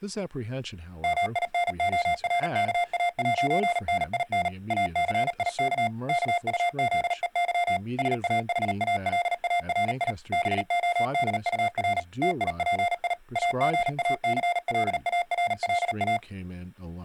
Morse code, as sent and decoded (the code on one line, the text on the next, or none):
-- .. -. --- .-. -.- .- .----. -. .. -. / .- -.-. .. -.- / -.- ..- --.. . -.-- / ... .- .... .- .-.. .- .-. .. / -... --- -.. ..- .-. / - .. .--. .. / .- --. .- -.-. .-.. .- .-. .-.. .-
MINORKA'NIN ACIK KUZEY SAHALARI BODUR TIPI AGACLARLA